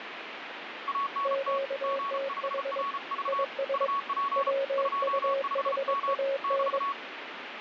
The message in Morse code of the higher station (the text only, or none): ANT G5RV UP 25M <BT>